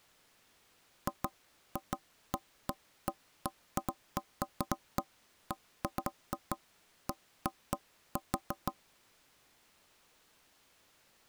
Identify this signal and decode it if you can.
Irregular knocks on wood. There is no code.